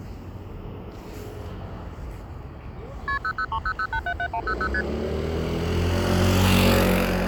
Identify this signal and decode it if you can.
Multi-frequency trunk signalling (R1, as on North American trunks), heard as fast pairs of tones, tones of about 70 ms, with street noise. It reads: KP 00300877100 ST